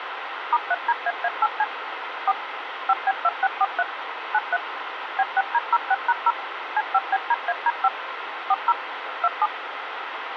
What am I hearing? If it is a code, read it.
DTMF, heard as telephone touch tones, dialled by machine, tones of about 40 ms, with radio hiss. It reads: *3DAA8C 4 5B2643 93 B6D06#0 C5BDAD5 40 27